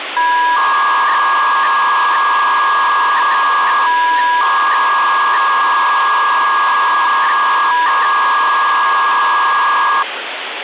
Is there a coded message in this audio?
Yes: 300-baud modem data (V.21 tones) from 0.2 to 10.0 s, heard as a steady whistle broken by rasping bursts, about 300 baud, 200 Hz shift, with phone line noise.